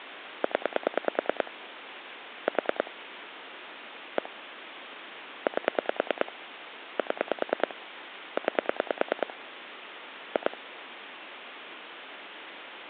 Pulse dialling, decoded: 0 4 1 8 7 9 2

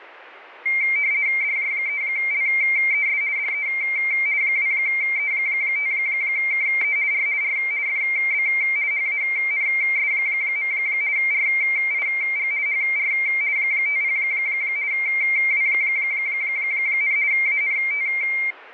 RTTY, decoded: DJ3LES DE 2E5KE R R FB HANS. RIG HR 50 W, ANT

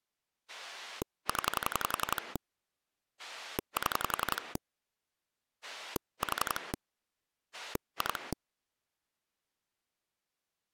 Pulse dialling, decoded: 0 7 4 2

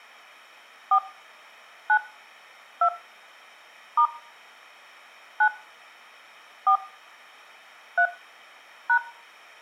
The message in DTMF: 4 9 2 * 9 4 3 #

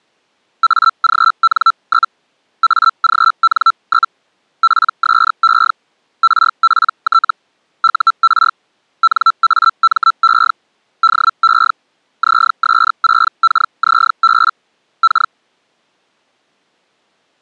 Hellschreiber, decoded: AGN? AGN? PSE RPT UR NAME DE ZS6KZB K

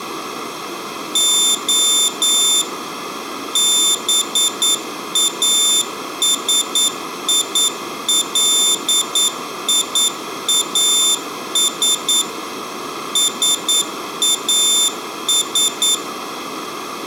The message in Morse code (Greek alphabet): Ο ΒΑΣΙΛΙΑΣ ΣΑΣ

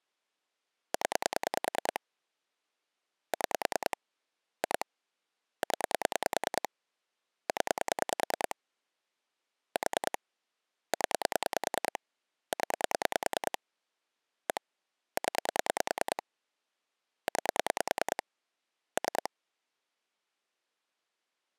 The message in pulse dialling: 0 6 2 0 0 4 0 0 1 0 9 3

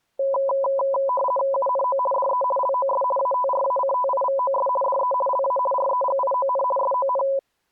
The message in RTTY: UNO DE LOS ATRACTIVOS DE LA REGION SON

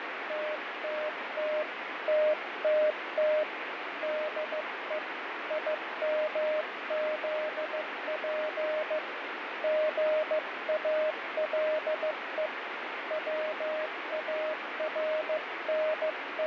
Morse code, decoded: TTT TTT DE IMZP GALE …

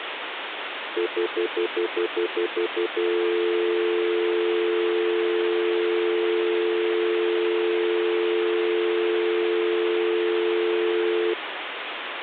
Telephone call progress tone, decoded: stutter dial tone

